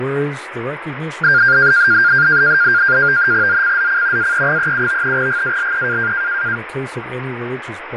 NAVTEX (SITOR-B), 100 baud, 170 Hz shift, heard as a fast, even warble, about 1500 Hz centre, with radio static, fading and speech in English. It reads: ZCZC AE37 GALE